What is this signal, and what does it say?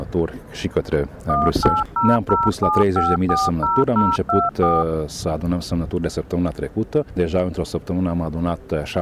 DTMF, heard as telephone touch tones, dialled by machine, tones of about 200 ms. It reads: 18007540024